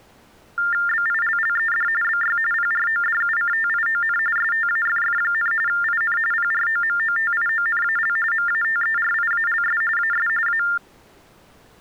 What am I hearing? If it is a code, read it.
TTY/TDD text telephone tones (45.45 baud Baudot), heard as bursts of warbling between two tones, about 400 Hz shift, 1600 Hz centre. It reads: BILLED BY PRODUCTION STAFF, IN PROMOTIONAL MATERIALS AS A